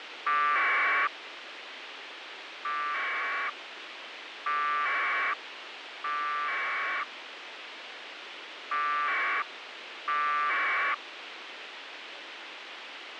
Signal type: packet radio (AX.25, as in APRS)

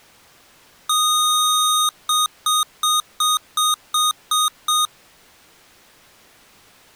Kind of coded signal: beep code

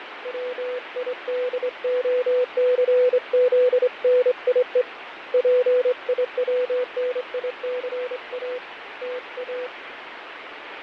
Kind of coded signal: Morse code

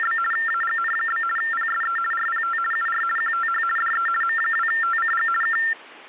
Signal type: RTTY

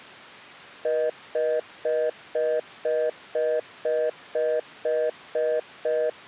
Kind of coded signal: telephone call progress tone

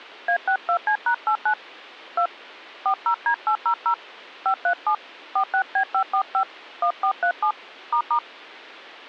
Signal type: DTMF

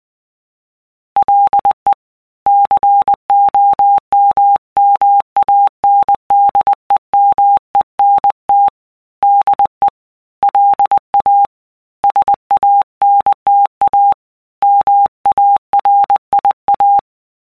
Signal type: Morse code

